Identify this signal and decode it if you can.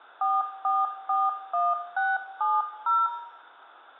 DTMF, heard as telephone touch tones, dialled by hand, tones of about 200 ms, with room echo. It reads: 4441670